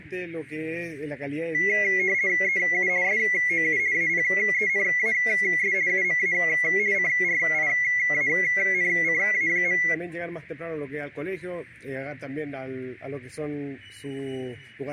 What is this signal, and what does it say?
RTTY (50 baud, 170 Hz shift), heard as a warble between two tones, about 2050 Hz centre. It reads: EU SOU APENAS UMA CRIANCA.